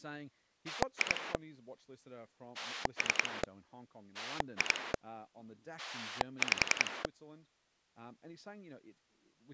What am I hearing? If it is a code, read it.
Pulse dialling, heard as a rotary dial, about 10 pulses a second, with speech in English. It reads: 2 3 2 5